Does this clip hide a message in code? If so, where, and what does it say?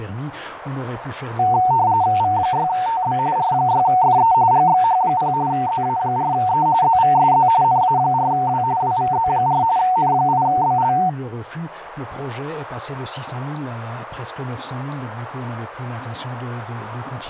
Yes: RTTY (45.45 baud, 170 Hz shift) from 1.4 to 11.1 s, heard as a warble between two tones, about 820 Hz centre, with radio static. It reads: V6TB R6FE GXH0 ZA4E ZVSZ NA4W WVZ4 N8BL